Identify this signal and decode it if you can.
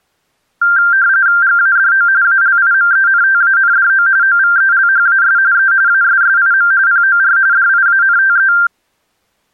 RTTY (45.45 baud, 170 Hz shift), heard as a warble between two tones, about 1480 Hz centre. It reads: GADO ALIMENTANDO OVELHAS E ASSIM POR DIANTE